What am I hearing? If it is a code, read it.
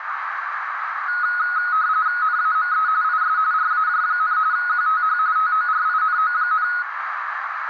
RTTY (45.45 baud, 170 Hz shift), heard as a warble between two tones, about 1360 Hz centre, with radio static and a narrow filter. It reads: NAME IS RAJ, QTH TORINO,